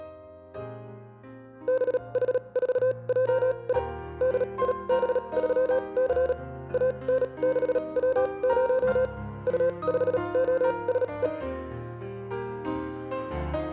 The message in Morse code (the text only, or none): BH4JI DIB3C AN6W0 U5OSE